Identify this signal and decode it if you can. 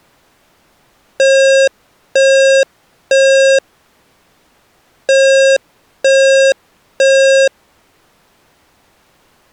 Alarm pattern, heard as an alarm's beeps, played twice, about 540 Hz. Temporal three. Smoke or fire, evacuate.